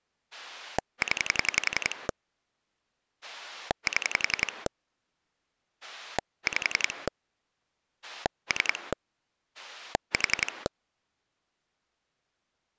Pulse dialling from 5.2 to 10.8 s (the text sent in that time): 5 3 4